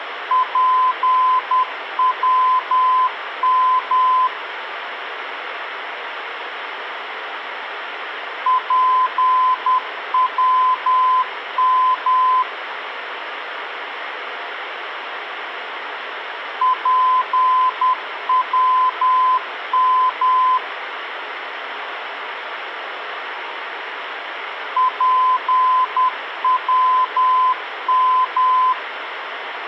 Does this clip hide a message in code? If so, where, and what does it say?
Yes: Morse code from 0.3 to 28.8 s, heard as a keyed tone, machine-sent, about 10 wpm, 1020 Hz, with radio hiss. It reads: PWM PWM PWM PWM